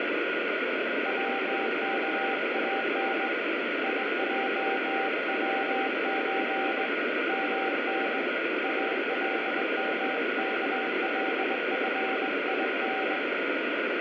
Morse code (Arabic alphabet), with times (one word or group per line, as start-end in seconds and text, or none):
1.1-3.3 وكان
3.8-6.8 يجوز
7.3-8.2 من
8.6-13.2 المكلفين